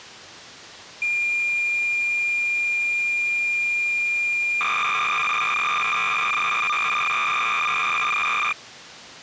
Cassette data (Kansas City type), 300 baud, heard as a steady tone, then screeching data.